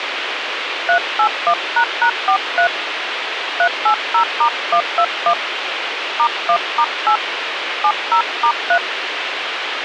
DTMF, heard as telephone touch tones, dialled by hand, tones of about 80 ms, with radio hiss. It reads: 381##43 380*121 *1*8 70*3